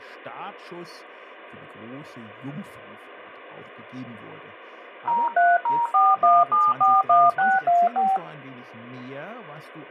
DTMF, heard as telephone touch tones, dialled by machine, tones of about 210 ms, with speech in German. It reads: 03041741625